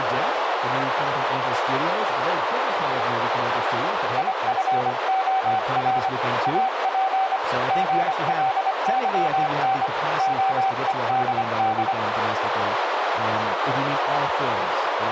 Morse code, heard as a keyed tone, hand-sent with a paddle, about 25 wpm, 770 Hz, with radio static, a narrow filter and speech in English. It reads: IFOR AP GLYN OEDD